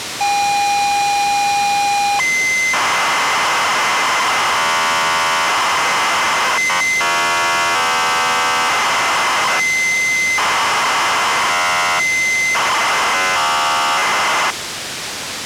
ZX Spectrum tape loading, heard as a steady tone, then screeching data, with tape hiss.